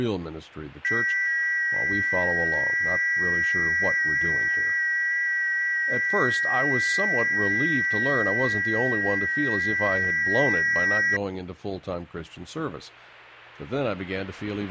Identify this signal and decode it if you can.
FT8 (several signals at once), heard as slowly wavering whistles, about 6.25 baud.